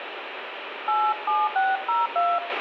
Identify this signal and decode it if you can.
DTMF, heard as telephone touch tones, dialled by hand, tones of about 250 ms, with radio hiss, a squelch burst at the end and room echo. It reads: 87602